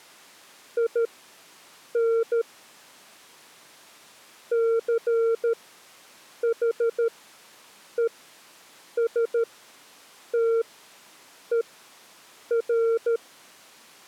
Morse code, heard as a keyed tone, machine-sent, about 13 wpm, spaced as for 7 wpm, 460 Hz. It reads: IN CHESTER